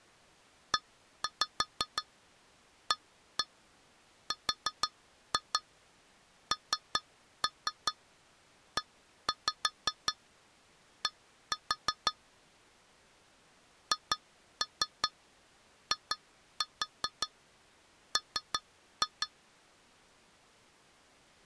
Tap code, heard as taps on glass, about 5 knocks a second. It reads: EARNED HIM